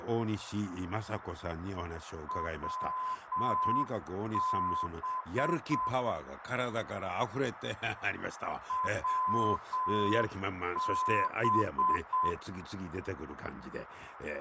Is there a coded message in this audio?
Yes: Morse code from 2.2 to 12.4 s, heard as a keyed tone, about 7 wpm, 1020 Hz, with radio static, fading, a narrow filter and speech in Japanese. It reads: WB WB